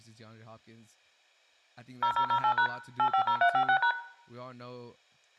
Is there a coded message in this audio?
Yes: DTMF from 2.0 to 3.9 s, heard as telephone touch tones, dialled by machine, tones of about 80 ms, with room echo and speech in English. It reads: 0008# 850356#